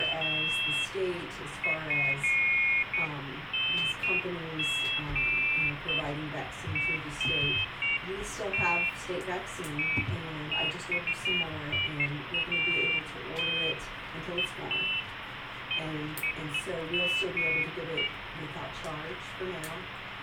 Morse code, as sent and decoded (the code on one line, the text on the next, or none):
none